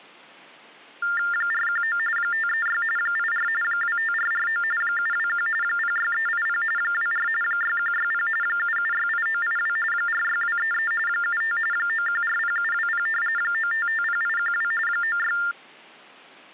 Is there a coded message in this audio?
Yes: TTY/TDD text telephone tones (45.45 baud Baudot) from 1.0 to 15.5 s, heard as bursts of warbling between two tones, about 400 Hz shift, 1600 Hz centre. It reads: 419 536 84 25449 721 06380 24 6160 7768982 46233 75 9140720 9550812 96